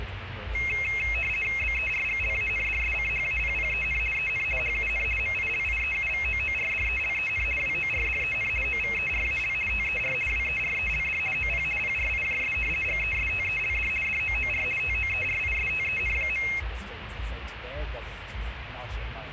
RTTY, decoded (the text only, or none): BERGLANDSCHAPPEN EN HUN MILIEUVOORDELEN WORDEN OVERAL TER WERELD OP PRIJS GESTELD DOOR TOERISTEN.